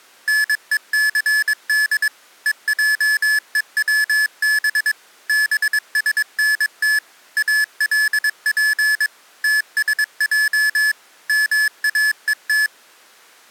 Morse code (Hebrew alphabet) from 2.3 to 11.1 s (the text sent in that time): ועוצב בשנת אלף תשע